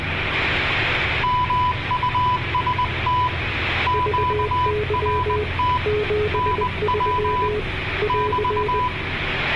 Morse code, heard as two keyed tones, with radio static, room echo and the noise inside a bus. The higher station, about 20 wpm, 1000 Hz: MUST QRT NW <BT>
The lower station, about 20 wpm, 420 Hz: VY 73 <AR>